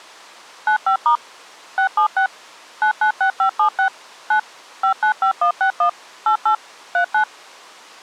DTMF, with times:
0.7-1.2 95*
1.8-2.3 676
2.8-3.9 996576
4.3-4.4 9
4.8-5.9 595161
6.3-6.5 88
6.9-7.2 39

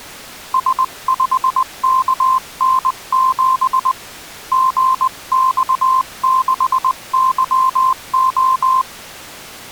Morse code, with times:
0.5-3.9 S5KN7
4.5-8.8 GX6YO

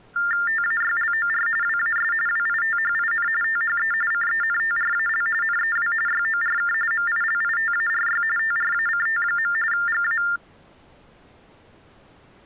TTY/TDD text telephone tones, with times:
0.5-1.5 TAYLOR
1.6-2.1 WAS
2.3-3.3 WITHIN
3.4-3.9 THE
4.1-5.3 CENTRAL
5.4-5.9 NEW
6.1-6.7 YORK
6.9-8.2 MILITARY
8.4-9.5 TRACT.
9.7-10.2 GA

